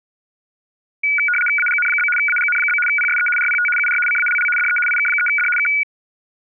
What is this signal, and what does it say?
RTTY (75 baud, 850 Hz shift), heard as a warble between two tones, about 1850 Hz centre. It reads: AGN? AGN? PSE RPT UR CALL DE IK3D K